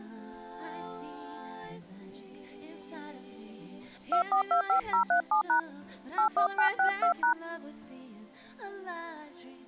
DTMF, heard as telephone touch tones, dialled by hand, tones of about 100 ms. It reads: 2425037# 81962#